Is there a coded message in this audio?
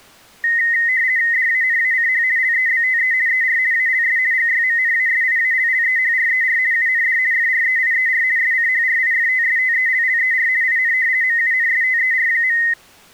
Yes: RTTY (50 baud, 170 Hz shift) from 0.4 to 12.7 s, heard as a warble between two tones, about 1950 Hz centre. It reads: DANACH LEBTE ER ALS GYMNASIALLEHRER UND FREIER SCHRIFTSTELLER IN MUNSTER.